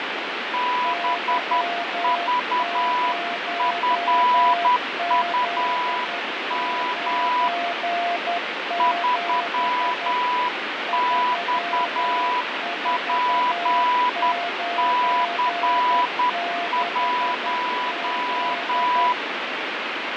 Morse code, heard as two keyed tones, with radio static and fading. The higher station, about 10 wpm, 990 Hz: BVFUM 3XPC1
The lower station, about 11 wpm, 690 Hz: Y0Z97 3496Z